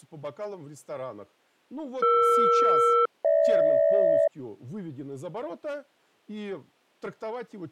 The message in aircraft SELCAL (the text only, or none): ER-GH